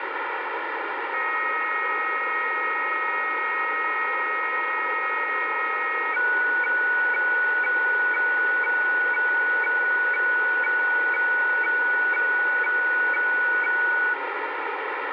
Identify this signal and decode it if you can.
Weather fax (radiofax), 120 lines a minute, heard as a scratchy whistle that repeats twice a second, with heavy radio static.